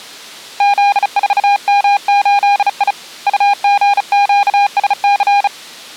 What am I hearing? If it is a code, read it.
Morse code, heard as a keyed tone, hand-sent with a bug key, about 35 wpm, 810 Hz. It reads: Z4M8I UGQSC